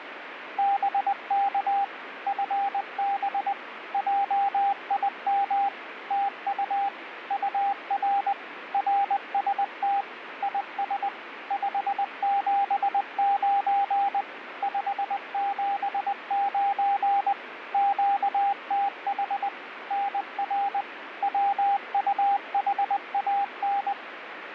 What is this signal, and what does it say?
Morse code, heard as a keyed tone, machine-sent, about 20 wpm, 800 Hz, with radio static. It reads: BK FB JIM TU UR RST IS 579 579 QTH NR WUHAN